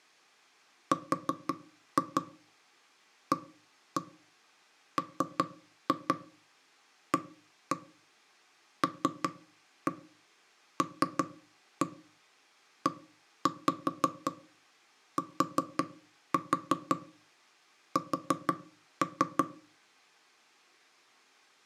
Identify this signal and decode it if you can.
Tap code, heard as knocks on wood, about 5 knocks a second. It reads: RAMALLETS